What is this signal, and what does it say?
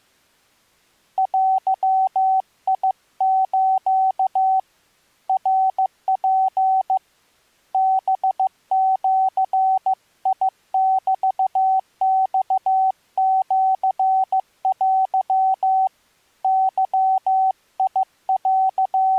Morse code (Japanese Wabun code), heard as a keyed tone, hand-sent with a paddle, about 15 wpm, 760 Hz. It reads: デス ナツ ハジメマシテ …